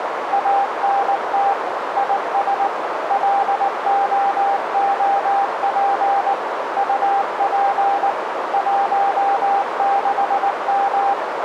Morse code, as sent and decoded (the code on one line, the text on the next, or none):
.- -. - / .. ... / .-.. --- --- .--. / ..- .--. / .---- -.... --
ANT IS LOOP UP 16M